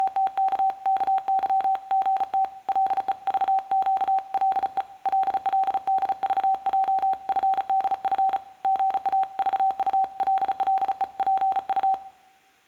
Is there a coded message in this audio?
Yes: Morse code (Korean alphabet) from 0.0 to 12.0 s, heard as a keyed tone, hand-sent with a paddle, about 35 wpm, 770 Hz, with room echo. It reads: … 가래가 끓는 소리까지